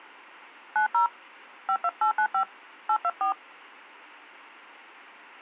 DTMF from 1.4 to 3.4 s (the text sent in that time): 52895 824